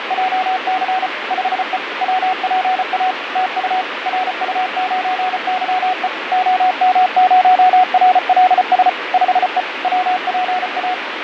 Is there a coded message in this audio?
Yes: Morse code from 0.0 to 11.0 s, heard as a keyed tone, machine-sent, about 34 wpm, 740 Hz, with radio static and fading. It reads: … 5E WPA TU RU9YE OM0RLS 5E WPA